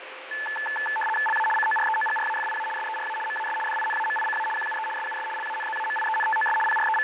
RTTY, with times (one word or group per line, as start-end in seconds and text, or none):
1.3-1.5 LA
1.6-2.7 COREOGRAFIA
2.8-3.2 SERA
3.3-3.6 MAS
3.7-4.5 DINAMICA
4.6-4.9 QUE
5.0-5.3 SUS
5.4-6.6 LANZAMIENTOS
6.7-7.0 …